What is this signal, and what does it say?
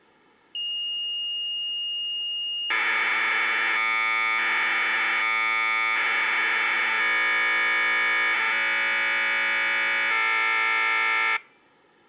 Commodore tape loading (standard loader), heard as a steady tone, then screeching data.